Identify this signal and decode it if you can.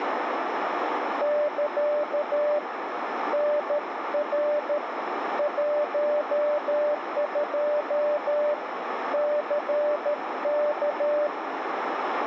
Morse code, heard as a keyed tone, hand-sent with a paddle, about 13 wpm, 590 Hz, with radio static and a narrow filter. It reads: <KA> NR 12 CK